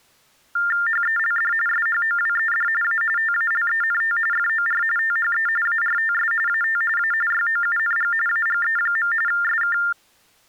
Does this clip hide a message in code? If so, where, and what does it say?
Yes: TTY/TDD text telephone tones (45.45 baud Baudot) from 0.6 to 9.9 s, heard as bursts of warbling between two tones, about 400 Hz shift, 1600 Hz centre. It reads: HELD SHOWED A TALENT FOR THE ARTS AT A YOUNG AGE. SK